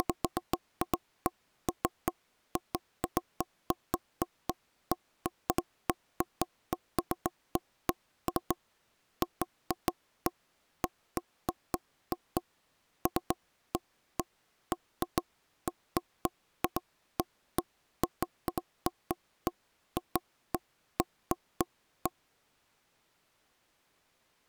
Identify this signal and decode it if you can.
Irregular taps on a table. There is no code.